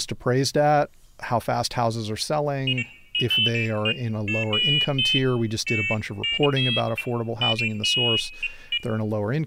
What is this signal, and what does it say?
Pairs of high tones at irregular times, with speech in English. There is no code.